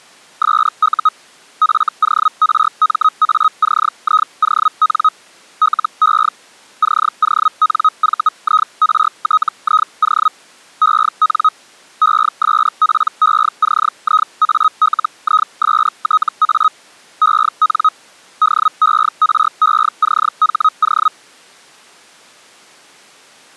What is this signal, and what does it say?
Hellschreiber (Feld-Hell, 122.5 baud), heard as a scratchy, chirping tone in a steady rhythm, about 1260 Hz. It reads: SU FORMACION LE CONVIRTIO EN ESPECIALISTA EN DERECHO